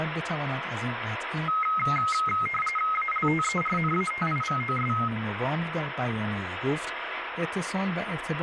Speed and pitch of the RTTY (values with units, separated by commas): 45.45 baud, 850 Hz shift, 1700 Hz centre